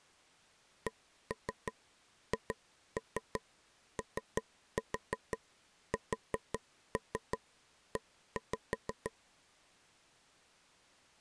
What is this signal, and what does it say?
Tap code, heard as taps on a table, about 5 knocks a second. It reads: CHOSE